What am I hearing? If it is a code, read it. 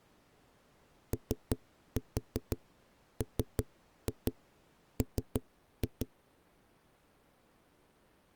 Tap code, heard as knocks on a wall, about 5 knocks a second. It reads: OMM